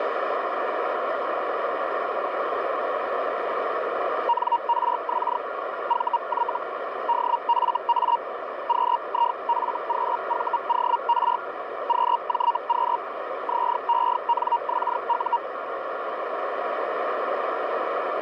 Hellschreiber (Feld-Hell, 122.5 baud), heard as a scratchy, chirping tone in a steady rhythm, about 940 Hz, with radio static and a narrow filter. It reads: NRX VY DFA QIFQVOR QJQ ZENXU